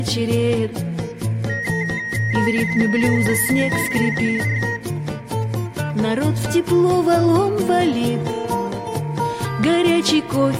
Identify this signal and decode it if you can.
RTTY (45.45 baud, 170 Hz shift), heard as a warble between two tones, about 1950 Hz centre. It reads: LEBENSJAHR